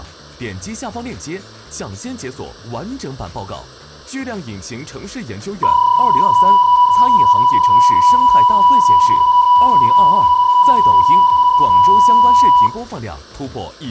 PSK31 (31.25 baud), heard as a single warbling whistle, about 980 Hz, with room echo.